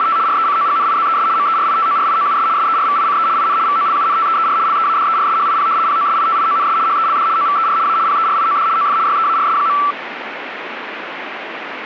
RTTY (75 baud, 170 Hz shift), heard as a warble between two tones, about 1240 Hz centre, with radio static. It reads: … RECOGNIZES MERITORIOUS SERVICE IN VOLUNTEER LEADERSHIP POSITIONS HELD OVER A PERIOD OF YEARS.